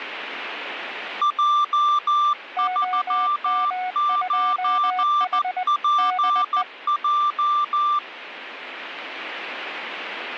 Morse code, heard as two keyed tones. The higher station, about 14 wpm, 1180 Hz: J39PJ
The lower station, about 20 wpm, 740 Hz: OM2H DE